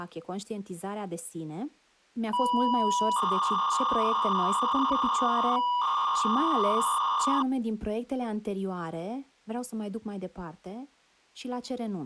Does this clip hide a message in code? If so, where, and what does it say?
Yes: 300-baud modem data (V.21 tones) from 2.3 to 7.4 s, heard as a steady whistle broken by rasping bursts, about 300 baud, 200 Hz shift, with speech in Romanian.